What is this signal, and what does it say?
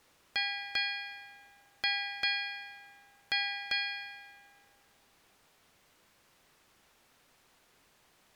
Ship's bell, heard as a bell. 6. Six half-hours of the watch have passed.